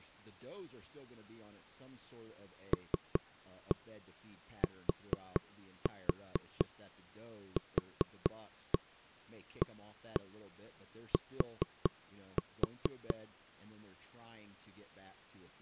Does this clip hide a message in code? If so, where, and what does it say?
Yes: tap code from 2.7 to 13.1 s, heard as knocks on wood, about 4 knocks a second, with speech in English. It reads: LTQAT